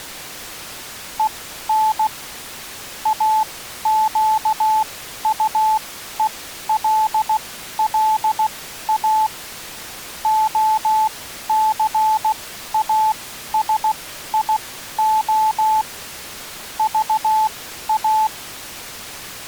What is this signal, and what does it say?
Morse code, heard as a keyed tone, machine-sent, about 16 wpm, spaced as for 12 wpm, 870 Hz. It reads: EN AQUELLA OCASIO VA